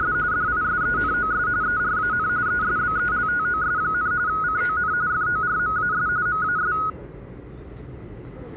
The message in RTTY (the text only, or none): … DISENOS ERAN ESBELTOS, CON FORMAS MAS